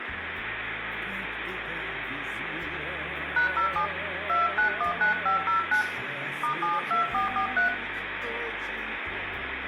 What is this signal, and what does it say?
DTMF, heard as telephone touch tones, dialled by hand, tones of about 130 ms, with phone line noise and room echo. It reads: #07 2919509 *72443